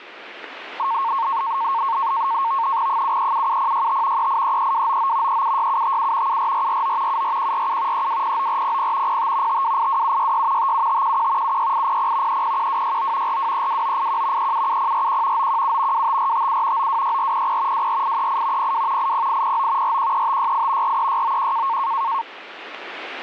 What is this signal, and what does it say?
NAVTEX (SITOR-B), 100 baud, 170 Hz shift, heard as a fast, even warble, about 1000 Hz centre, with radio static. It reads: 7377065 3833299 376757 74449 74147 3209400 05 5282766 57511 76800 301269 4232981 377041 917 25457 926400 24838 02 80809 413568 43691